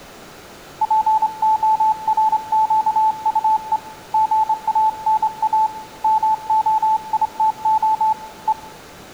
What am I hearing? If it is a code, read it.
Morse code, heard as a keyed tone, hand-sent with a straight key, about 27 wpm, 870 Hz, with room echo. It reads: PORQUE GANA MOITO E